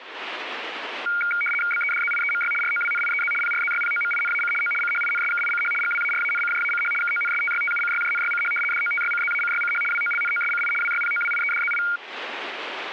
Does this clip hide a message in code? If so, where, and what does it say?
Yes: RTTY (75 baud, 850 Hz shift) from 1.1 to 12.0 s, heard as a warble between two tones, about 1850 Hz centre. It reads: BEDZIEMY ROWNIEZ PRZYPOMINAC O CHINSKICH GWARANCJACH KONSTYTUCYJNYCH DOTYCZACYCH WOLNOSCI WYPOWIEDZI